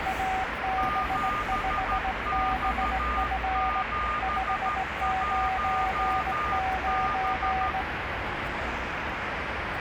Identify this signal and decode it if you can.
Morse code, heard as two keyed tones, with radio static and street noise. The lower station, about 18 wpm, 760 Hz: AB5BF 599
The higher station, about 13 wpm, 1210 Hz: 7X71B